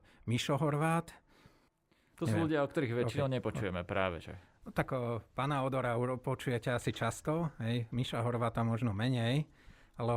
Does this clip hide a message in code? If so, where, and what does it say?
No, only speech in Slovak.